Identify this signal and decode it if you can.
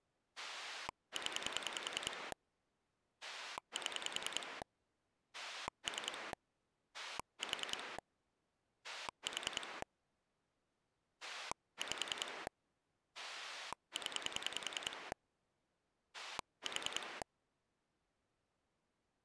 Pulse dialling, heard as a rotary dial, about 10 pulses a second. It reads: 0 7 3 4 4 5 0 4